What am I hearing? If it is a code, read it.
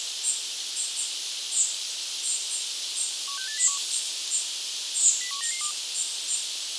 Five-tone selective call (CCIR), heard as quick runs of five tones, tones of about 100 ms, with radio hiss. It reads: 16801 01992